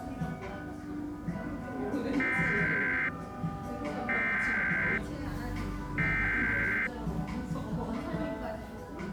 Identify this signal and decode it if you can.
Emergency Alert System (SAME) tones (header bursts), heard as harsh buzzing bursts, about 520.83 baud, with the noise of a cafe.